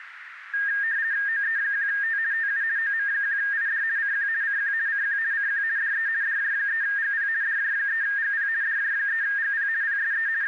RTTY (50 baud, 170 Hz shift), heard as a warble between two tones, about 1700 Hz centre, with radio static and a narrow filter. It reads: OE1T TU OM1ID CQ CQ CQ CQ DE DJ3GP DJ3GP DJ3GP PSE …